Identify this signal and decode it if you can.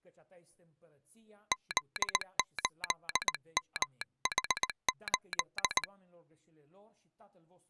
Morse code, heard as a telegraph sounder, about 19 wpm. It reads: Z8MH8